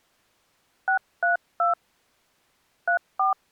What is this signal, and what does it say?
DTMF, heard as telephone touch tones, dialled by hand, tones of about 120 ms. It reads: 632 34